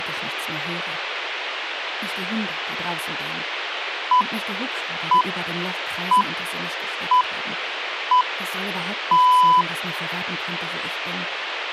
Radio time signal (six pips, as the Greenwich Time Signal), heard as pips, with radio hiss.